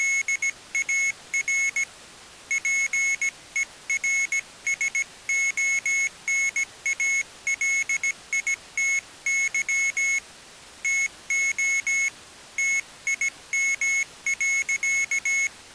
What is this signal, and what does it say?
Morse code, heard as a high beeper, hand-sent with a paddle, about 17 wpm, 2200 Hz. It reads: … PERSONALITY TO TIM.